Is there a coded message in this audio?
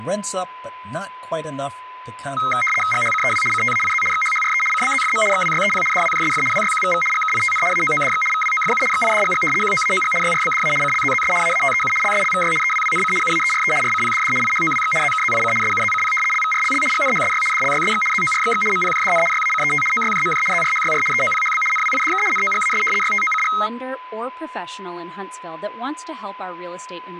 Yes: RTTY (75 baud, 850 Hz shift) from 2.4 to 23.7 s, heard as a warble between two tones, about 1700 Hz centre, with a steady whistle near 1010 Hz and speech in English. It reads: GHCEW CTAIZ XHHRE CBZFM XWYEP DWJSF WYQVV GKITN AOODX VWOFU XIDGG QOAOG YRBDA CLZZS AATEU LSLVY EWWNC UAERE RCPDD IHOWX ZKZIC SUZCP LVRLL GNHSY DLYSX ZORXX MPJDN YACET OYJMJ ZRHYR EOPHB NWIDK NOGAS YTOCG